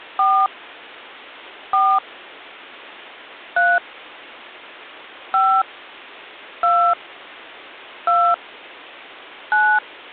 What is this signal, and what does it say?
DTMF, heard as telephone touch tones, dialled by hand, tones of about 270 ms. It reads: 4 4 3 5 2 2 9